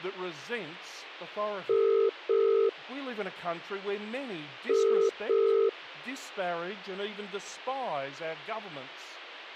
Telephone call progress tone (as in the UK, Ireland, Australia and similar networks), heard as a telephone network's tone, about 400, 450 Hz, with speech in English. Ringback tone.